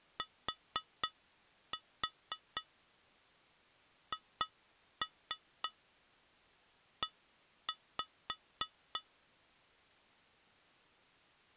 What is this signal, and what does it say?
Tap code, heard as taps on glass, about 3 knocks a second. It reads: THE